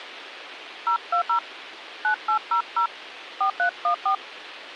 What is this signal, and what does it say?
DTMF, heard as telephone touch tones, dialled by hand, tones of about 100 ms, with radio hiss. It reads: 020 9800 4314